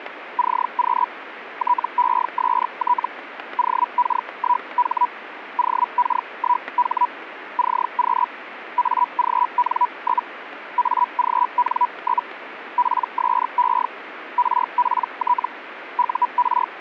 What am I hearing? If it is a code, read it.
Hellschreiber (Feld-Hell, 122.5 baud), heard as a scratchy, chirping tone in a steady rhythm, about 980 Hz, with radio static and static crashes. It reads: CQ TEST OK1H OK1H CQ AGN? AGN? PSE RPT UR